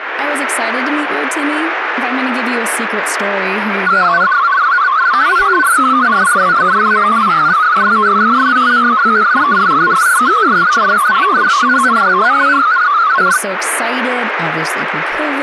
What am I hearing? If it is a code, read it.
Multi-tone FSK (Olivia or MFSK type), about 500 Hz wide, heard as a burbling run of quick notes, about 62.5 baud, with radio static and speech in English.